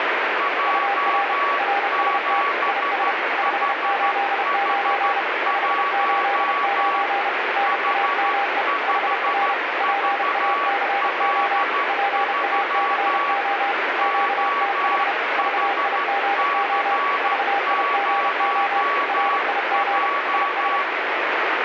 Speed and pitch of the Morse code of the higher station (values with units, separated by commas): 13 wpm, 1130 Hz